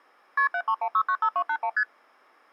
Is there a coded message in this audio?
Yes: multi-frequency trunk signalling (R1, as on North American trunks) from 0.4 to 1.8 s, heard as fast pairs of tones, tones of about 70 ms. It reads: KP 731695281 ST